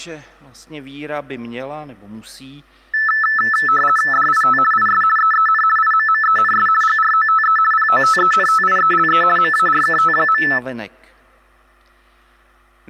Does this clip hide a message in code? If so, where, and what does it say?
Yes: RTTY (50 baud, 450 Hz shift) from 2.9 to 10.6 s, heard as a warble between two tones, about 1550 Hz centre. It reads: DIT IS EEN IMMENS GROTE POTENTIELE MARKT.